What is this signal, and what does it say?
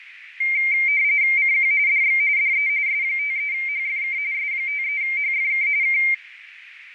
RTTY (45.45 baud, 170 Hz shift), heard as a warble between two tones, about 2200 Hz centre, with radio static. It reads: CQ DX DE S53HFK S53HFK K